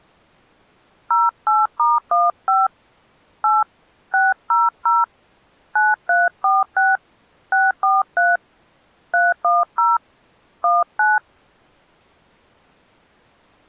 DTMF, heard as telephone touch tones, dialled by hand, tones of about 190 ms. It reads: 08*15 8 600 9346 643 310 19